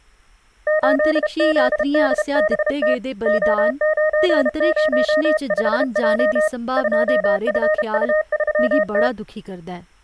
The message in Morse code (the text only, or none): 8ZDBT O905J 2FU3T